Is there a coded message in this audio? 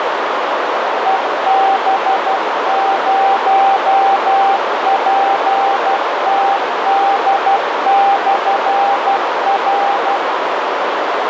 Yes: Morse code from 1.0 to 10.2 s, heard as a keyed tone, machine-sent, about 12 wpm, 790 Hz, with heavy radio static and a narrow filter. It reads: EB0PTD/R